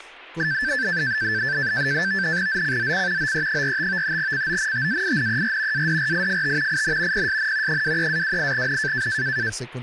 NAVTEX (SITOR-B), 100 baud, 170 Hz shift, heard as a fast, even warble, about 1650 Hz centre, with static crashes and speech in Spanish. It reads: ZCZC OE45 CONTAINER ADRIFT IN PSN 23-28N